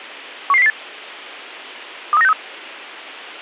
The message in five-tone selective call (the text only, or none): 11008 23963